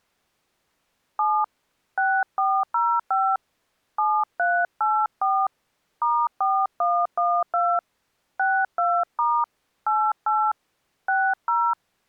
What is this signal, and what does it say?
DTMF, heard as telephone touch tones, dialled by hand, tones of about 250 ms. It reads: 7 6405 7384 *4112 62* 88 60